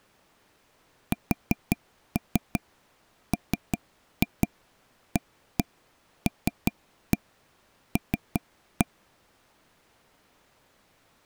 Tap code, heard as taps on a table, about 5 knocks a second. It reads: SMALL